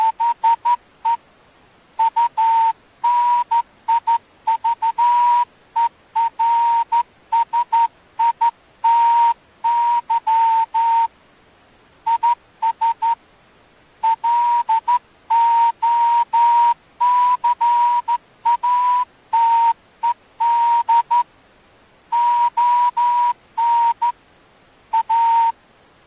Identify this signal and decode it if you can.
Morse code, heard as a whistle, hand-sent with a straight key, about 13 wpm. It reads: … UNIVERSITY IS LOCATED ON A